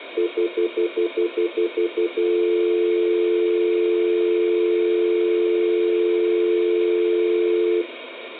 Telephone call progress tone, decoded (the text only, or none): stutter dial tone